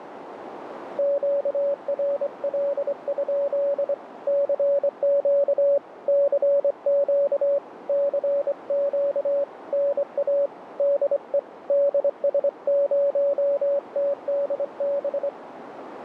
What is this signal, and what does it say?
Morse code, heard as a keyed tone, hand-sent with a straight key, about 24 wpm, 560 Hz, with radio static and a narrow filter. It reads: QRL? CQ CQ CQ NA DE DS0TDB